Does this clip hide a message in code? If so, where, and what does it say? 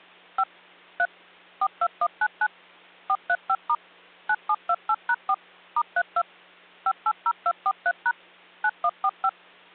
Yes: DTMF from 0.4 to 9.3 s, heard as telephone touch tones, dialled by machine, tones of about 60 ms, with hum. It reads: 5 3 42199 435* 9728#4 *32 580243# 9145